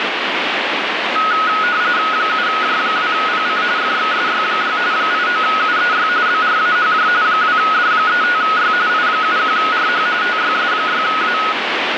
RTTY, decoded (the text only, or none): 7J2PC FXSY6 89UEY BRAHJ 2D35Y I71RH TYS6A